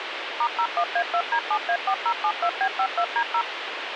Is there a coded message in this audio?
Yes: DTMF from 0.4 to 3.4 s, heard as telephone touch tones, dialled by machine, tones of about 70 ms, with radio hiss. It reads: *01A2D7A4072B52D0